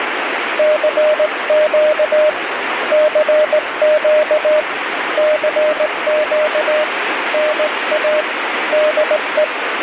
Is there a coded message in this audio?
Yes: Morse code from 0.5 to 9.5 s, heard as a keyed tone, hand-sent with a straight key, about 18 wpm, 610 Hz, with radio static. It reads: CQ CQ CQ NA DE